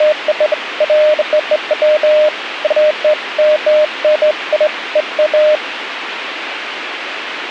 Beeps of irregular length, with radio hiss. There is no code.